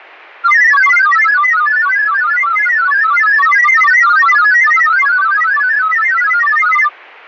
Multi-tone FSK (Olivia or MFSK type), about 1000 Hz wide, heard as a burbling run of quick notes, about 31.25 baud.